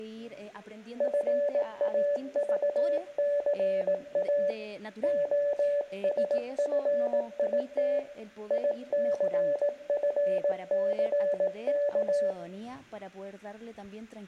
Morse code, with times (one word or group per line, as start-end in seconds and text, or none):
1.0-4.5 FAVCA
5.0-8.0 OSFIT
8.5-12.3 ICFCK